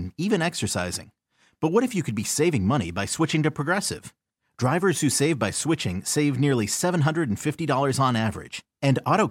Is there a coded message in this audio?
No.